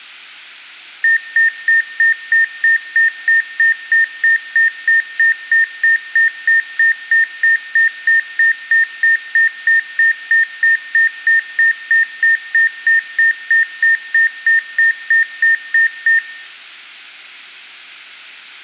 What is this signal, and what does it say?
Evenly repeated beeps, with room echo. There is no code.